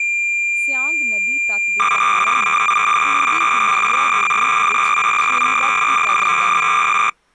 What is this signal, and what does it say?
Cassette data (Kansas City type), 300 baud, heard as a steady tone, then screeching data, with speech in Punjabi.